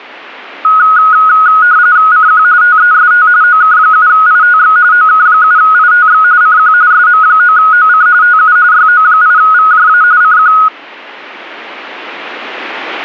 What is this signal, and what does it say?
RTTY (45.45 baud, 170 Hz shift), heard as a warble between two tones, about 1360 Hz centre. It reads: CQ TEST OK7ITX OK7ITX CQ SM9OC TU YO8VJA CQ